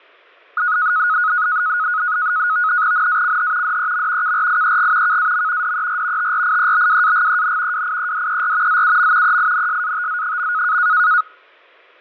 NAVTEX (SITOR-B), 100 baud, 170 Hz shift, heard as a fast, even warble, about 1360 Hz centre, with fading and static crashes. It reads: NACH DEM KRIEG KAM DER TRIEBWAGEN WIEDER ZUM EINSATZ.